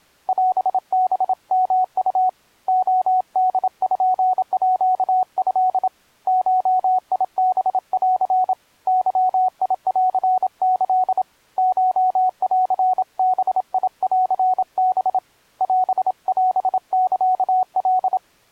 Morse code (Japanese Wabun code), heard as a keyed tone, hand-sent with a paddle, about 27 wpm, 740 Hz. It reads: オハヨウ レポート ゴハン ゲンキ コンバンハ オオサカ